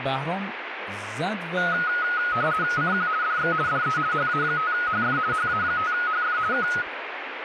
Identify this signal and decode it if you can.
RTTY (50 baud, 170 Hz shift), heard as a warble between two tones, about 1360 Hz centre, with radio static and speech in Persian. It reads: CQ DX DE HA5HF HA5HF K